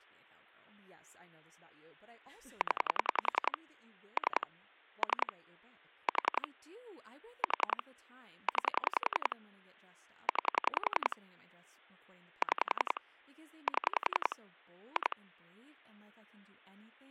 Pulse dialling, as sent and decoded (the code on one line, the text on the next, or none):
10 / 3 / 3 / 4 / 4 / 9 / 9 / 6 / 7 / 2
0 3 3 4 4 9 9 6 7 2